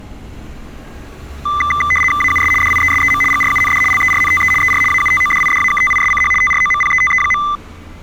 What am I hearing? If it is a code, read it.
RTTY (75 baud, 850 Hz shift), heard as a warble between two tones, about 1600 Hz centre, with street noise. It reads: AUS DIESEM GRUND LERNTE ER AUTODIDAKTISCH TROMPETE.